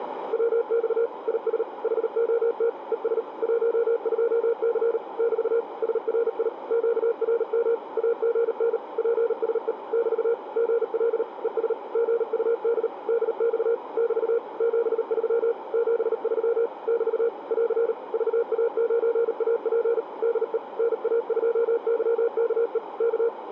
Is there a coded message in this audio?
Yes: Morse code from 0.3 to 23.3 s, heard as a keyed tone, machine-sent, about 38 wpm, 470 Hz, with radio static and a narrow filter. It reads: WX IS HOT ES 12C <BT> SRI QRM AGN PSE <BT> GL ES GUD DX <BT> 73 73 <BT> <AR> VA9AP DE NA2YKE K